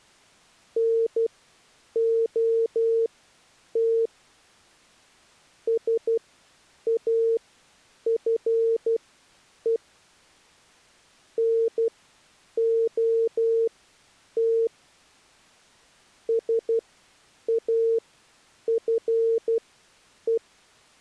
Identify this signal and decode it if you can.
Morse code, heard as a keyed tone, machine-sent, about 12 wpm, spaced as for 8 wpm, 460 Hz. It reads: NOT SAFE NOT SAFE